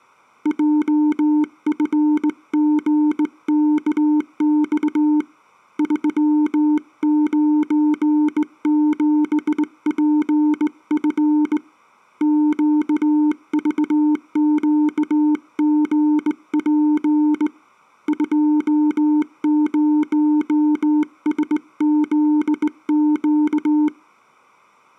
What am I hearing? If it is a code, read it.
Morse code, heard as a keyed tone, hand-sent with a straight key, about 19 wpm, 300 Hz. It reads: JFGKX 397PF QVQGP 20SZQ